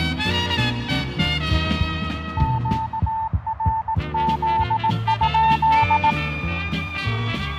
Morse code, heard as a keyed tone, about 18 wpm, 890 Hz, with radio static and fading. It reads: QRZ?